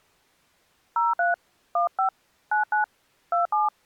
DTMF, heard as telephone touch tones, dialled by hand, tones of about 130 ms. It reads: 03 15 99 27